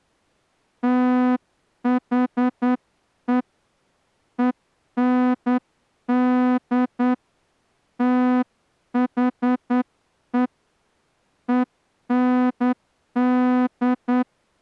Morse code, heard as a horn, hand-sent with a straight key, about 9 wpm. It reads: THE END THE END